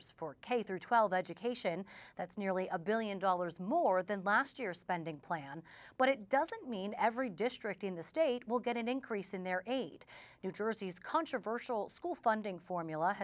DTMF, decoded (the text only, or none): none